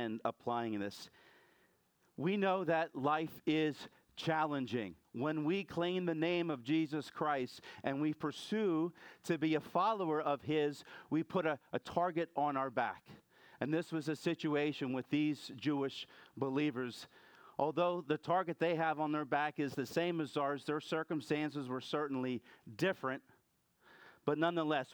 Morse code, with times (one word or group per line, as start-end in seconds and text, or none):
none